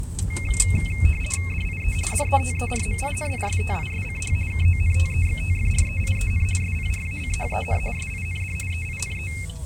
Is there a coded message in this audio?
Yes: RTTY (50 baud, 450 Hz shift) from 0.3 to 9.5 s, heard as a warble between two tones, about 2350 Hz centre, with the noise inside a car. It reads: DIE DETERMINISTISCH KONTEXTFREIEN SPRACHEN SIND EINE